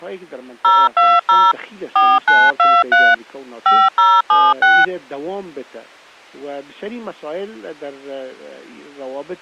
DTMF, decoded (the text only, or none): 020 4923 5076